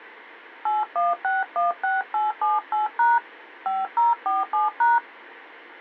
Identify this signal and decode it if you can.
DTMF, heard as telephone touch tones, dialled by hand, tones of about 170 ms. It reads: 81616878# 5047#